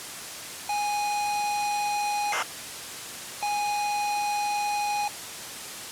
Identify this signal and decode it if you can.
ZX Spectrum tape loading, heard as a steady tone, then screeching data, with tape hiss.